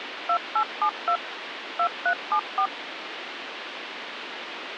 DTMF, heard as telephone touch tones, dialled by machine, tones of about 80 ms, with phone line noise. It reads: 2872 2374